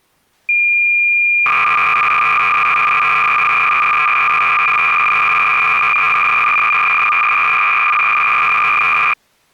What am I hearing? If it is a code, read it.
Cassette data (Kansas City type), 300 baud, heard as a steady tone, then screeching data.